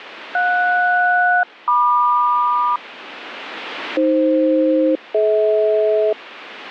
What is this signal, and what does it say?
Aircraft SELCAL, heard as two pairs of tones, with radio static. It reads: JS-MQ AF-DH